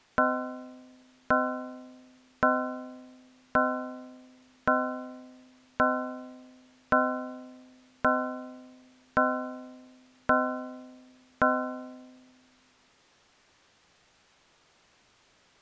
Clock strike, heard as a bell. 11. Eleven o'clock.